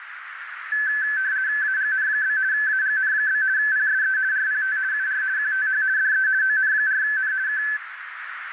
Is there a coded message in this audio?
Yes: RTTY (50 baud, 170 Hz shift) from 0.7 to 7.8 s, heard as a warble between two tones, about 1650 Hz centre, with radio static and a narrow filter. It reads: AGN? AGN? PSE RPT UR QTH DE ON4N K